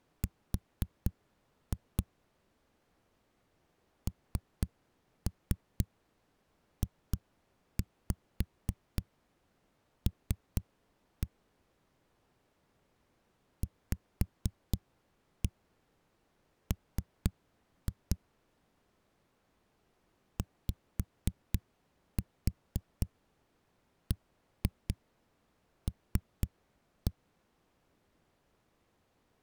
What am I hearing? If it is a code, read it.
Tap code, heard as knocks on a wall, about 4 knocks a second. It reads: R NJL VM YBL